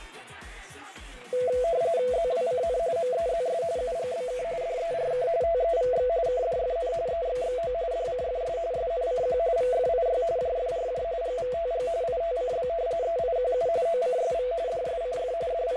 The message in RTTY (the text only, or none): ZWCN MEZS UGBK DERK TEVX KDFN EXXO DCFS SNCQ VFIY JFRJ GVTG ITCB EIQU OCSV DSCF …